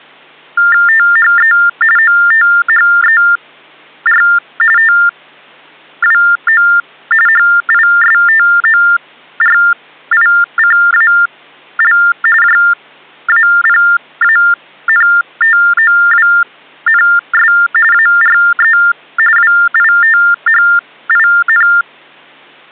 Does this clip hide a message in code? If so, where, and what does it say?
Yes: TTY/TDD text telephone tones (45.45 baud Baudot) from 0.6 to 21.8 s, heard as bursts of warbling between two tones, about 400 Hz shift, 1600 Hz centre. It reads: THE OTHER TWO HISTORICAL JAPANTOWNS ARE WITHIN